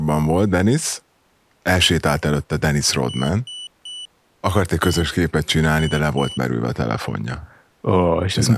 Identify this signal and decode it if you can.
Beep code, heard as a piezo beeper, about 2950 Hz, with speech in Hungarian. 3-1-2. In Phoenix BIOS tables: DMA register failure.